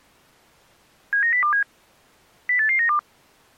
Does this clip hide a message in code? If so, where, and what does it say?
Yes: five-tone selective call (CCIR) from 1.1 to 3.0 s, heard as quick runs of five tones, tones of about 100 ms. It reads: 79027 08892